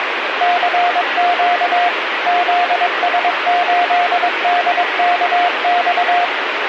Morse code, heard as a keyed tone, machine-sent, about 22 wpm, 710 Hz, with radio static. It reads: CQ ZS8DKX